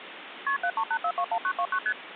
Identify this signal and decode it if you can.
Multi-frequency trunk signalling (R1, as on North American trunks), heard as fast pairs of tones, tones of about 70 ms, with phone line noise. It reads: KP 738421929 ST